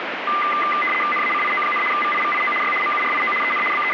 RTTY (75 baud, 850 Hz shift), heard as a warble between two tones, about 1600 Hz centre, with radio static. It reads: NACIO, VIVIO Y MURIO EN …